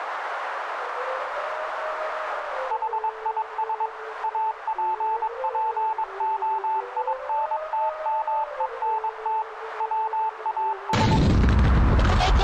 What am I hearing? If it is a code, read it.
Morse code, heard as a keyed tone, machine-sent, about 22 wpm, 880 Hz, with radio static and a narrow filter. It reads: HIS APPOINTMENT WAS